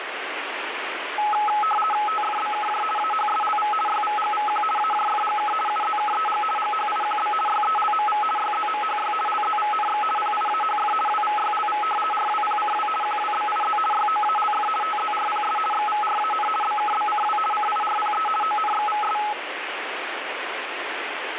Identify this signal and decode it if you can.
RTTY (50 baud, 450 Hz shift), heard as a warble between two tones, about 1070 Hz centre, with radio static. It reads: TFBKJ AHSLV YVGVQ AJFGK UZKEG GHIQB YELMV YZMHY LZVNX PIAHF WVYLV RWPCW QWBIZ YOALF TZRPS XVRAN BKBCW CIRPE ONXVS